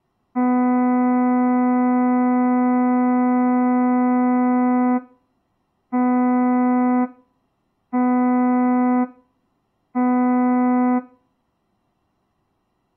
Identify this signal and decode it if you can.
Ship horn signal, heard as a ship's horn, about 250 Hz, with room echo. 1 long, 3 short. At sea: a vessel under tow in fog.